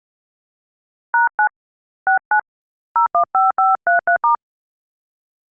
DTMF, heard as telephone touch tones, dialled by hand, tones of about 130 ms. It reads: #9 69 015533*